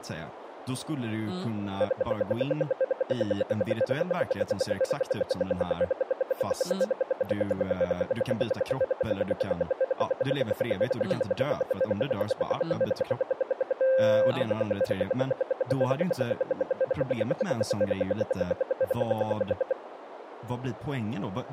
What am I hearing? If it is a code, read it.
Radio time signal (RWM, Moscow), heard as ten pulses a second, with radio static and speech in Swedish.